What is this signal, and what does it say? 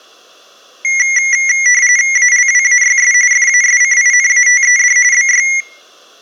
RTTY (45.45 baud, 170 Hz shift), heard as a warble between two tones, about 2050 Hz centre, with room echo. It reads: ALWAYS FASCINATED BY